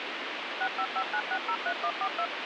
DTMF, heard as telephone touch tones, dialled by machine, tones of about 70 ms, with radio hiss. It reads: 6559603142